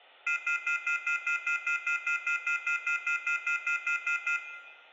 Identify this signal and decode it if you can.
Telephone call progress tone (North American plan), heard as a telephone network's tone, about 1400, 2050, 2450, 2600 Hz, 0.1 s on and 0.1 s off, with room echo. Off-hook warning tone.